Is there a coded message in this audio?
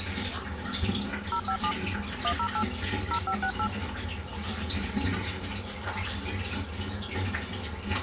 Yes: DTMF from 1.3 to 3.7 s, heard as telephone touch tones, dialled by hand, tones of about 80 ms, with the noise of a restroom. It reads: 057 108 0568